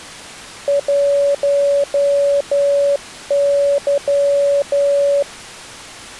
Morse code, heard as a keyed tone, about 11 wpm, 570 Hz. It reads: 1Y